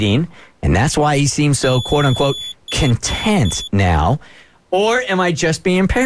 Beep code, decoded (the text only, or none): 1 long, 3 short